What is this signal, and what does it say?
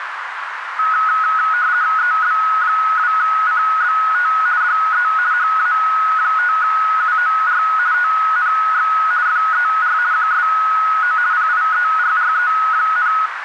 RTTY (50 baud, 170 Hz shift), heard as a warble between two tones, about 1370 Hz centre, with radio static and a narrow filter. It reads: EB2CBT DE HA5UOR TNX FER QSO PIERRE,